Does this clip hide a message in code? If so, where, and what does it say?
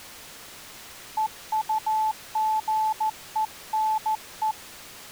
Yes: Morse code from 1.1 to 4.6 s, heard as a keyed tone, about 14 wpm, 870 Hz. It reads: EUGENE